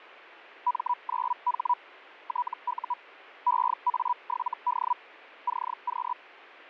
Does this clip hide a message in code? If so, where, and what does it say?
Yes: Hellschreiber (Feld-Hell, 122.5 baud) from 0.7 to 6.1 s, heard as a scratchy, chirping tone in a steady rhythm, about 980 Hz. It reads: M9H TU EA7D CQ